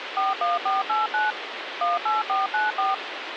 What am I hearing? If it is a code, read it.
DTMF, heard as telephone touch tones, dialled by machine, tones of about 170 ms, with phone line noise. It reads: 41489 18494